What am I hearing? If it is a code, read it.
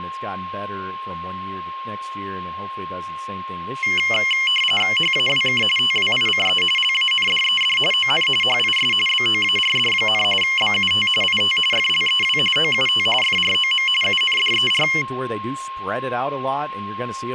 RTTY (45.45 baud, 850 Hz shift), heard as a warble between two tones, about 2550 Hz centre, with a steady whistle near 1070 Hz and speech in English. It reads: HAWK TWICE LANDED ON HIS BOARD, BUT IT FLEW OUT FROM UNDER